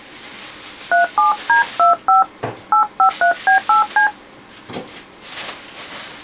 DTMF, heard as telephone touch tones, dialled by hand, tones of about 110 ms, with kitchen noise. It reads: 37D25 853B8C